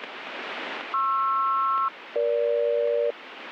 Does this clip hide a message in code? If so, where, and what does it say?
Yes: aircraft SELCAL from 0.9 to 3.1 s, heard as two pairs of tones, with radio static. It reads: PR-EG